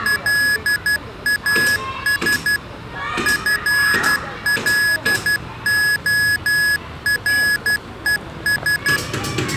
Morse code, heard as electronic beeps, machine-sent, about 12 wpm, 1700 Hz, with the noise of a residential street. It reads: LAS FLORES